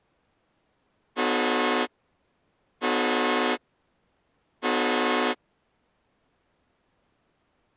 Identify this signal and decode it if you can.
Train horn signal, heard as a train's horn. 3 short. On North American railways: when stopped, the train will back up.